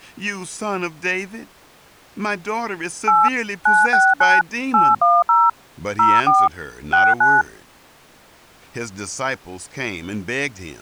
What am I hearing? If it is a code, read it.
DTMF, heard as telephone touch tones, dialled by machine, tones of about 210 ms, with speech in English. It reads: 8 969 810 04 69